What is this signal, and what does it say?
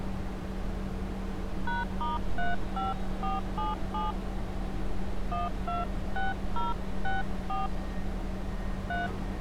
DTMF, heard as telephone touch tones, dialled by hand, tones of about 170 ms, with street noise. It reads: #*35477 126064 3